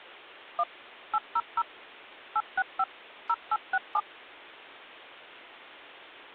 DTMF, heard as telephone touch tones, dialled by machine, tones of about 50 ms. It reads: 1 800 865 0867